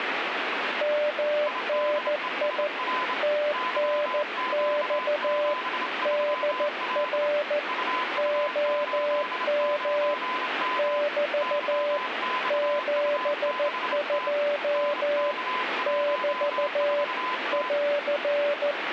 Morse code, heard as two keyed tones, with radio static. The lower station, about 14 wpm, 590 Hz: MNI TNX DR OM <BT> 72 <BT> <AR>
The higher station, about 27 wpm, 1020 Hz: IDESR YQ73L UU89M YXU6T NK14T